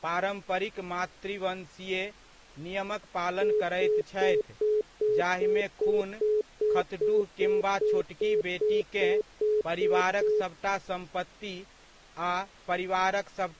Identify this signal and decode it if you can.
Telephone call progress tone (single-tone plan, as in most of Europe), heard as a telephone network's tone, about 420 Hz, 0.2 s on and 0.2 s off, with speech in Maithili. Congestion tone.